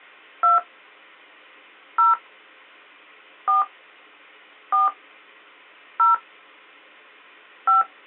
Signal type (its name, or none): DTMF